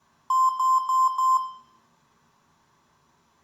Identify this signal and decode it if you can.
Beep code, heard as beeps from a small speaker, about 1040 Hz, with room echo. 4 short. In AMI BIOS tables: system timer failure; in Dell tables: memory read or write failure.